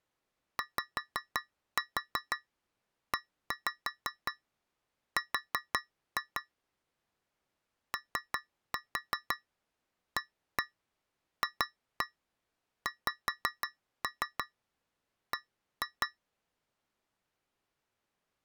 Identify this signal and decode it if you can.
Tap code, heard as taps on a metal pipe, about 5 knocks a second. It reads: YER OAFXB